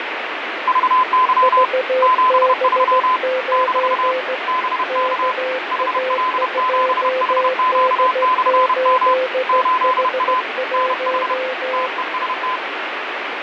Morse code, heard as two keyed tones, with radio static. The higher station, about 31 wpm, 1020 Hz: VY 73 - BK HL7HQ/M 8A NH TEST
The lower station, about 16 wpm, 520 Hz: VB9 KA2D8H1